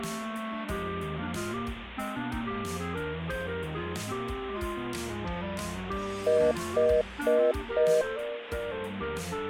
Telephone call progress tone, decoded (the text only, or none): congestion tone